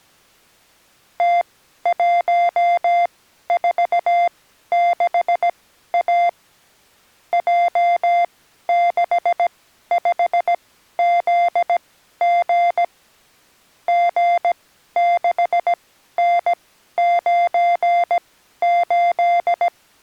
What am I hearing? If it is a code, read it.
Morse code, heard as electronic beeps, machine-sent, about 17 wpm, spaced as for 12 wpm, 700 Hz. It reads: T146A J65ZG G6N98